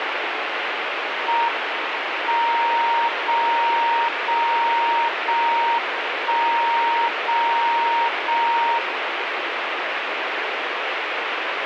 Radio time signal (JJY), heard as a tone whose level steps once a second, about 930 Hz, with radio static. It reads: M 0 0 0 1 0 0 1